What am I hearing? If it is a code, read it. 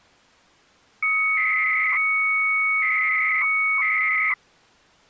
300-baud modem data (Bell 103 tones), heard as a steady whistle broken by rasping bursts, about 300 baud, 200 Hz shift.